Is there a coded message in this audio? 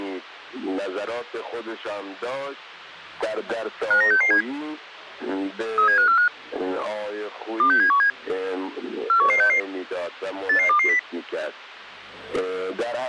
Yes: five-tone selective call (CCIR) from 3.9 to 11.0 s, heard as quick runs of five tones, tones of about 100 ms. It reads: 59667 37545 26717 41166 88220